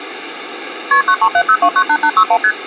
Multi-frequency trunk signalling (R1, as on North American trunks), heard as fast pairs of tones, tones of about 70 ms. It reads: KP 9370298861 ST